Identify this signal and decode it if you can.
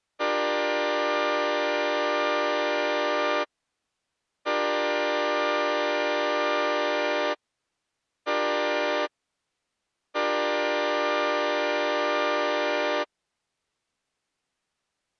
Train horn signal, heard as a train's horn. 2 long, 1 short, 1 long. On North American railways: approaching a public crossing.